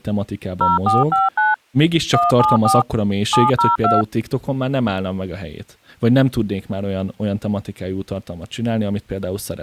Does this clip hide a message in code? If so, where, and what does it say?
Yes: DTMF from 0.6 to 4.0 s, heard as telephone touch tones, dialled by machine, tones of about 170 ms, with speech in Hungarian. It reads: 0459 174 702